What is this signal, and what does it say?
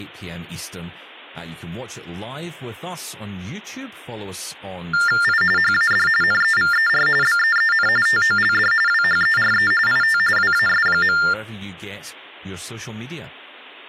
TTY/TDD text telephone tones (45.45 baud Baudot), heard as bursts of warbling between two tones, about 400 Hz shift, 1600 Hz centre, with speech in English. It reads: I HAD NEVER BEEN TOLD WHERE IT WAS.